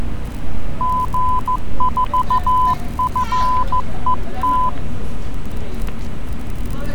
Morse code, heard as a keyed tone, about 14 wpm, 1010 Hz, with static crashes and street noise. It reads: G4FET